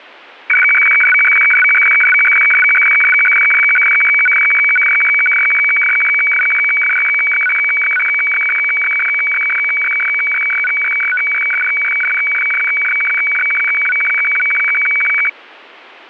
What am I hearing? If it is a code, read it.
Weather fax (radiofax), 120 lines a minute, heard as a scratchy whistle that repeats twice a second.